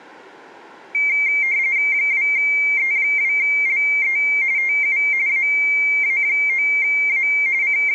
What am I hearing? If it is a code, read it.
RTTY (45.45 baud, 170 Hz shift), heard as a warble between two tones, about 2200 Hz centre. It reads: 2E2LE TU AA9A …